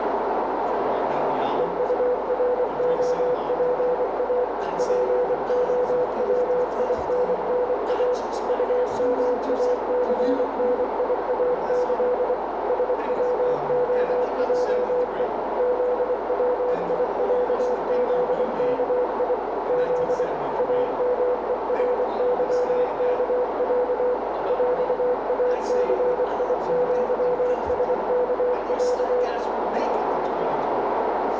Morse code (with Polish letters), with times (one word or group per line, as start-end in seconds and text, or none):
1.6-4.4 EUROPA
4.8-8.1 POWINNA
8.5-12.3 UMACNIAĆ
12.7-15.2 SWOJE
15.6-19.3 ZWIĄZKI
19.7-20.2 Z
20.6-24.1 AMERYKĄ
24.5-29.2 ŁACIŃSKĄ